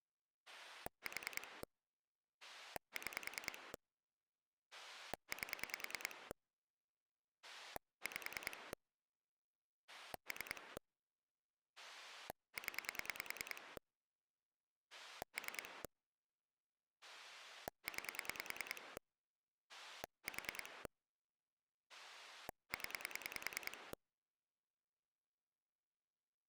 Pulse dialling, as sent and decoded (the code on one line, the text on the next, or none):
4 / 6 / 8 / 5 / 3 / 10 / 3 / 9 / 4 / 10
4 6 8 5 3 0 3 9 4 0